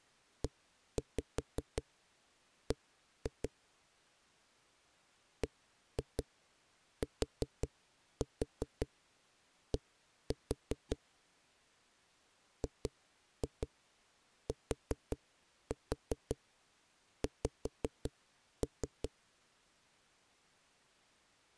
Tap code, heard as knocks on a wall, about 5 knocks a second. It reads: EB BTD GTX